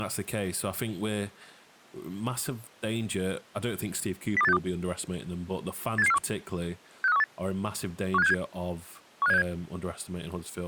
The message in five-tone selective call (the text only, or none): 02862 87741 65318 15767 15767